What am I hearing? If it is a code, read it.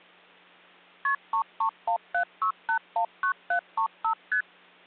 Multi-frequency trunk signalling (R1, as on North American trunks), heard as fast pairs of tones, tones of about 90 ms. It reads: KP 33176819735 ST